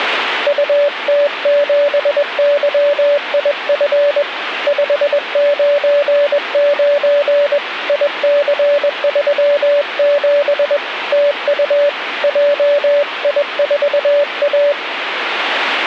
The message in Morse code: UT7YIF 599 IC37 TU JI4A

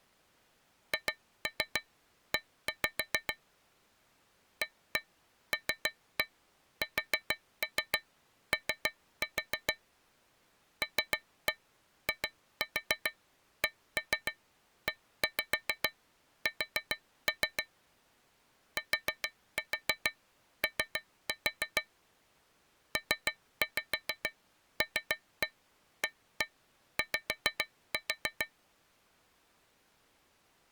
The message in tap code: HE ALSO LIKES TO PLAY

